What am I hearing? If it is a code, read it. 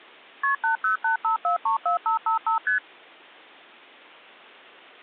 Multi-frequency trunk signalling (R1, as on North American trunks), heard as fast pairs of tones, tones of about 120 ms. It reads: KP 8085434555 ST